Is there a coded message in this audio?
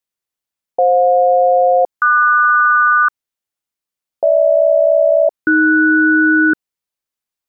Yes: aircraft SELCAL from 0.8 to 6.5 s, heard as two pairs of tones. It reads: FJ-QS GH-AS